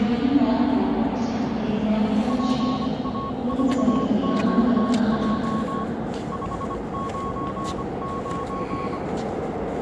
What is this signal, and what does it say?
Morse code, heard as a keyed tone, hand-sent with a bug key, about 25 wpm, 1100 Hz, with the noise of a subway station. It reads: PA4QJ 599